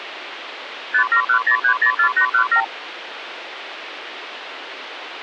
Multi-frequency trunk signalling (R2, with the far end's replies), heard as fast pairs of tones, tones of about 90 ms, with phone line noise. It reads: 5710304817